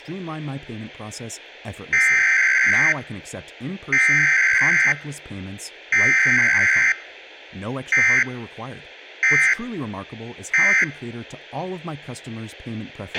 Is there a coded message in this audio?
Yes: Emergency Alert System (SAME) tones (header bursts, then end-of-message bursts) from 1.9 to 10.8 s, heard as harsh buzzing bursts, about 520.83 baud, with a squelch burst at the end and speech in Danish.